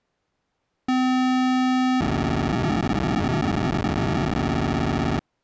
POCSAG pager data (512 baud), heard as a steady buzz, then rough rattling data.